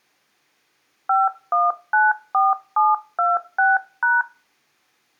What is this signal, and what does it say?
DTMF, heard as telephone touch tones, dialled by hand, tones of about 180 ms. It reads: 5194726#